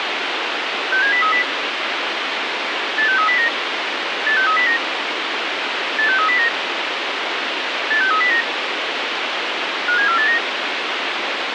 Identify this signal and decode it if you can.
Five-tone selective call (CCIR), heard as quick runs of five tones, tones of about 100 ms, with radio hiss. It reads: 67030 86309 86309 86309 86309 57489